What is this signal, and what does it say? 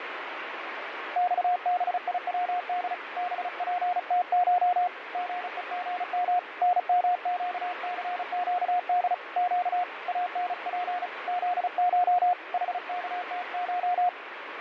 Morse code (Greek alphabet), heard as a keyed tone, hand-sent with a paddle, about 35 wpm, 720 Hz, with radio static. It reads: ΞΒΙΩΔ ΒΠΤΧ ΓΕΓΜ ΝΜΨΘΨΔ Ψ ΑΝΠ ΖΧ ΗΚΤΧ